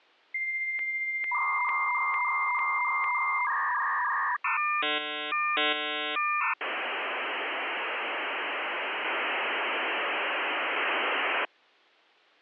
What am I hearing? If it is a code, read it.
Dial-up modem handshake (V.34 or later), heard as a whistle, warbles, then hiss.